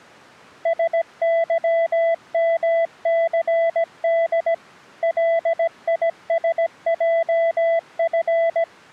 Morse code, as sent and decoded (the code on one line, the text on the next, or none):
... -.-- -- -.-. -.. / .-.. .. ... .--- ..-.
SYMCD LISJF